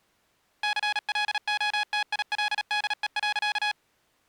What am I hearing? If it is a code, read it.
Morse code, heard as electronic beeps, machine-sent, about 37 wpm, 840 Hz. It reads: CLOTILDE.